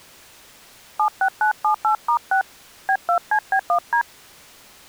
DTMF, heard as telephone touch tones, dialled by hand, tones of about 90 ms. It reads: 76978*6 B2CB1D